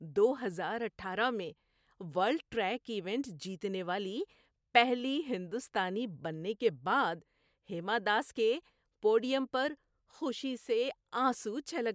Speech in Urdu. There is no code.